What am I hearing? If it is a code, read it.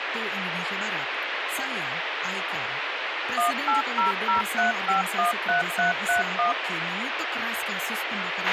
DTMF, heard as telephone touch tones, dialled by machine, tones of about 130 ms, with radio hiss, a squelch burst at the end and speech in Indonesian. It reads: 18003513331